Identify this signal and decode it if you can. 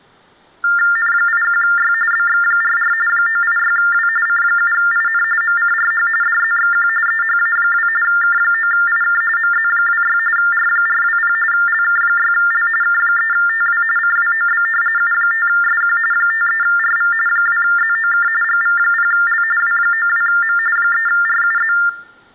TTY/TDD text telephone tones (45.45 baud Baudot), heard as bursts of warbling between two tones, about 400 Hz shift, 1600 Hz centre. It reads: N81Y BX44 986W C7IN MCRH DZXQ EHA2 K9IK MZ26 R420 LK6L K3TW CWOB U5SQ 53RV 2ZOK GV0L W92M 3RUZ